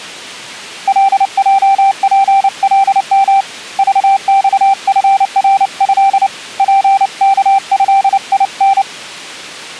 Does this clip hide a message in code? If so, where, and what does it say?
Yes: Morse code (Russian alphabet) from 0.8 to 8.9 s, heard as a keyed tone, hand-sent with a paddle, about 29 wpm, 780 Hz. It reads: ЛЙПЛМ ЖЬФРЭ ПКЭИН